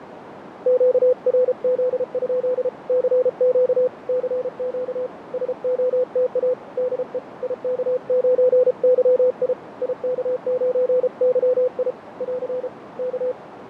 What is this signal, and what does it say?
Morse code, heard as a keyed tone, hand-sent with a paddle, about 33 wpm, 500 Hz, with radio static, fading and a narrow filter. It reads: QRZ? CQ CQ SOTA DE IK9YI IK9YI <AR> K